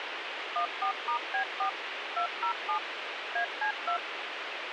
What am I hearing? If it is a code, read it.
DTMF, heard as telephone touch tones, dialled by machine, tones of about 100 ms, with radio hiss and a squelch burst at the end. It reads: 14*B4 207 AC2